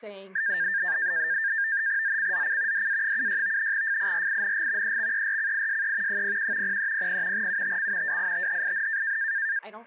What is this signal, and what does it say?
NAVTEX (SITOR-B), 100 baud, 170 Hz shift, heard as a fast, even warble, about 1700 Hz centre, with speech in English. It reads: ZCZC DA76 FIRING EXERCISE 01 0300 UTC WITHIN